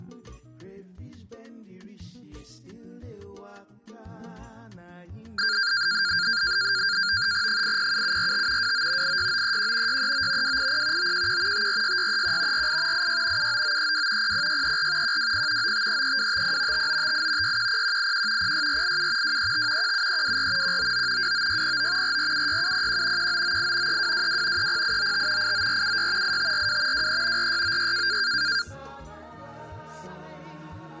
NAVTEX (SITOR-B), 100 baud, 170 Hz shift, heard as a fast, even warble, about 1500 Hz centre. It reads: 807745 29 86931 639 280 911 546631 48 86 79932 00634 120 9533250 5958 610181 06487 235 17324 199 29609 4476701 1998 3222 30895 89476 8542 23 4696